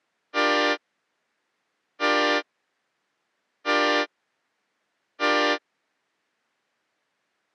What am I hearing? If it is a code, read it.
Train horn signal, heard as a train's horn. 4 short. On North American railways: a request for a signal to be given or repeated.